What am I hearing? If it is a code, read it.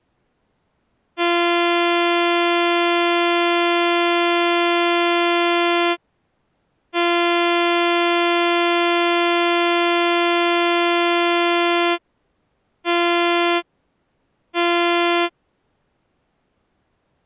Ship horn signal, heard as a ship's horn, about 340 Hz. 2 long, 2 short. At sea: I intend to overtake on your port side.